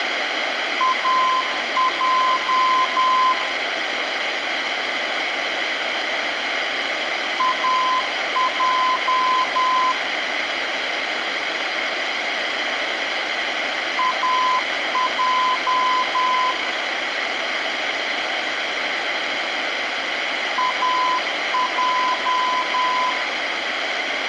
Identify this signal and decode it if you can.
Morse code, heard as a keyed tone, machine-sent, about 10 wpm, 1020 Hz, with radio hiss and room echo. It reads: AJ AJ AJ AJ